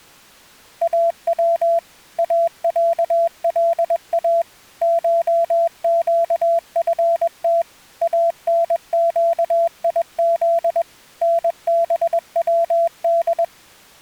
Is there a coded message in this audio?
Yes: Morse code (Persian alphabet) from 0.8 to 13.5 s, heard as a keyed tone, machine-sent, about 21 wpm, 670 Hz. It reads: او اصلا شگفت انگیز نبود